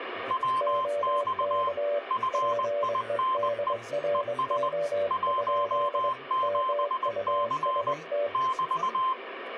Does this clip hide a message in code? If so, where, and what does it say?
Yes: Morse code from 0.2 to 9.2 s, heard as two keyed tones, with radio static and speech in English. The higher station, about 20 wpm, 1040 Hz: WX FINE ES 17C <BT>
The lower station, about 23 wpm, 580 Hz: OK PEDRO? MUST